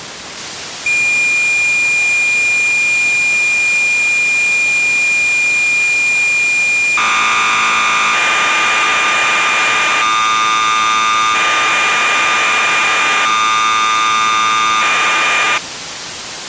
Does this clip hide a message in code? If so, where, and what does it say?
Yes: cassette data (Kansas City type), 1200 baud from 0.9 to 15.6 s, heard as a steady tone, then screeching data, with tape hiss.